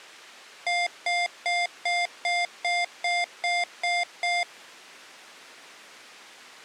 Beep code, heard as beeps from a small speaker, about 700 Hz. 10 short. In AMI BIOS tables: CMOS shutdown register error.